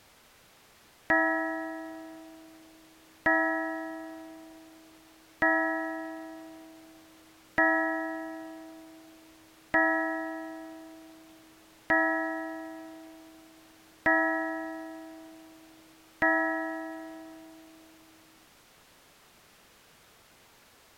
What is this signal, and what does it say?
Clock strike, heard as a bell. 8. Eight o'clock.